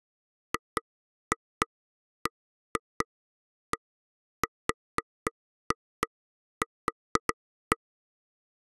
Irregular taps on a table. There is no code.